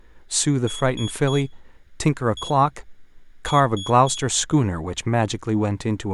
Beep code, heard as a piezo beeper, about 3350 Hz, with room echo and speech in English. 3-1-3. In Phoenix BIOS tables: interrupt mask register failure.